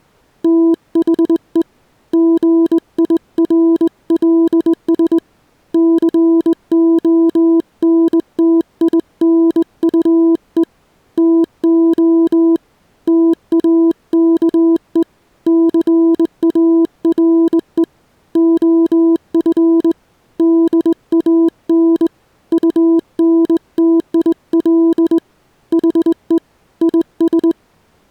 Morse code, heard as a keyed tone, hand-sent with a straight key, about 20 wpm, 330 Hz. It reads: THE GIRLS CONTINUE TO TAKE CARE OF DAN UNTIL HE IS